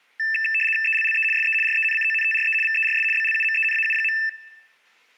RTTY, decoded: ELLE SE RENCONTRE VERS BLUMENAU.

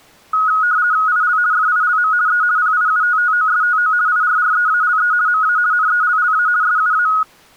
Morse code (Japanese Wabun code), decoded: none

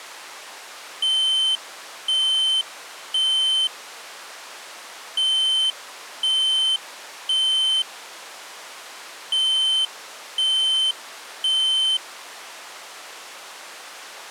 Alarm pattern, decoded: temporal three

